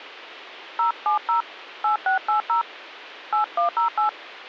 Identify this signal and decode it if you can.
DTMF, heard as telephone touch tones, dialled by hand, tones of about 120 ms. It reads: 070 8680 8108